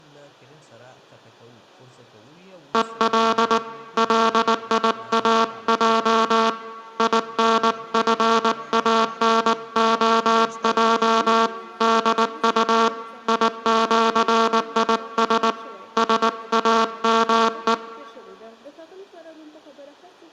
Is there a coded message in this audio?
Yes: Morse code (with Esperanto letters) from 2.7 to 17.8 s, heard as a buzzer, hand-sent with a paddle, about 19 wpm, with room echo. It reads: EL LIAJ INFANOJ DU IĜIS SAME